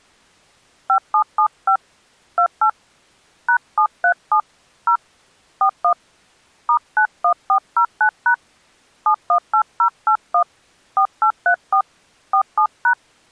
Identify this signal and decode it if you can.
DTMF, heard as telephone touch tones, dialled by hand, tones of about 80 ms. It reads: 5775 28 #737 0 41 *91409# 718081 4834 47#